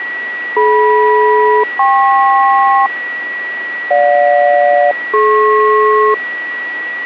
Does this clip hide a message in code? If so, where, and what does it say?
Yes: aircraft SELCAL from 0.6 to 6.1 s, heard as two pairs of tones, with radio static and a steady whistle near 1930 Hz. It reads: DM-KP GJ-DP